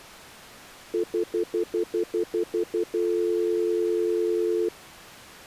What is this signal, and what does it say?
Telephone call progress tone (North American plan), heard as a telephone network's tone, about 350, 440 Hz, 0.1 s on and 0.1 s off. Stutter dial tone.